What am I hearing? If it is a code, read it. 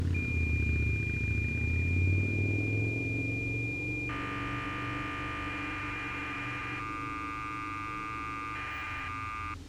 Cassette data (Kansas City type), 1200 baud, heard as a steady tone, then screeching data, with street noise.